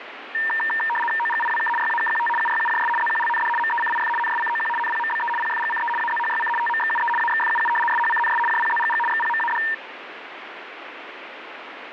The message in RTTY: OGIWK YAKQT UYUJS ZQLND MECIF NSCOQ NPMBE PFGCE AZHYC TMXUE AXFUU SHCNS JPZGG XPMAD

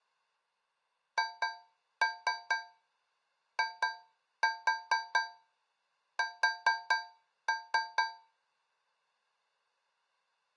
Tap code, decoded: HIS

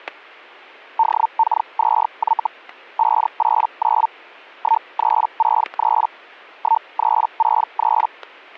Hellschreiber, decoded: DK2Y 589 1363 1363

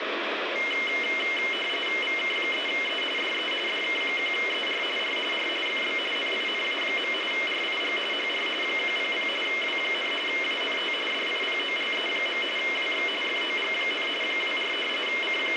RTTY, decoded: VK3E DE DK1ER R R FB NINA. RIG HR 100 W, ANT DIPOLE. WX FOG, 24 …

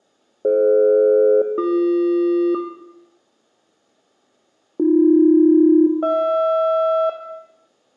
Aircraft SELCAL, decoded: DF-BQ AB-HR

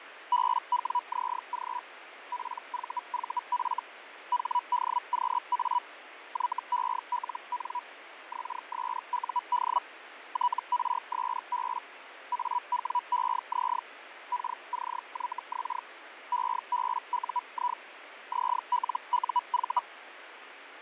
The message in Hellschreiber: BWZG PVVF HDQA YELN XSUD TRSB AWEZ KCYX EBUI ZLUV

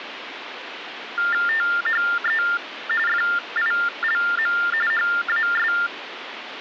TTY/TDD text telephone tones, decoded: THE FILM HAS

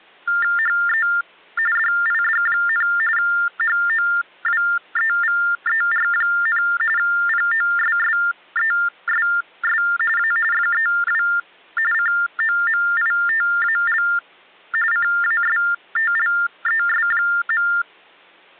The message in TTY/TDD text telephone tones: HE DID, HOWEVER, POSSESS A FEW COMITAL CASTLES.

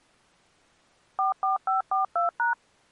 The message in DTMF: 44542#

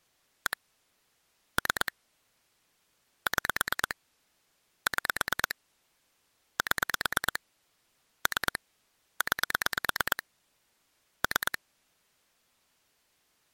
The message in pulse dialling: 1 3 6 6 7 3 9 3

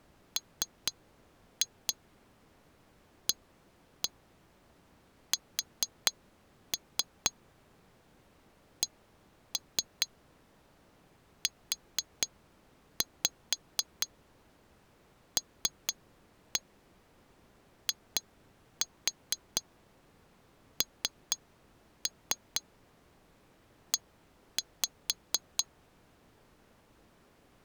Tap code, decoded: MASCULINE

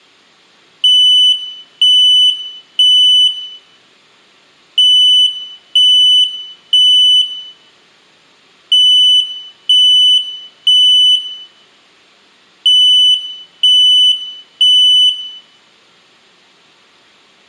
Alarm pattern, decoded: temporal three

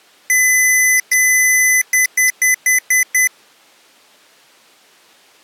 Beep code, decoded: 2 long, 6 short

